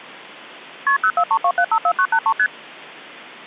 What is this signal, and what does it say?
Multi-frequency trunk signalling (R1, as on North American trunks), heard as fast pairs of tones, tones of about 70 ms. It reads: KP 0432754983 ST